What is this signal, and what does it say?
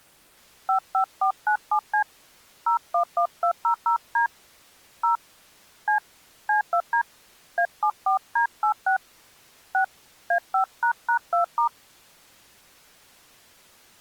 DTMF, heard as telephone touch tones, dialled by hand, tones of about 100 ms. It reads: 55497C 011200D 0 C C2D A74D86 6 A5##2*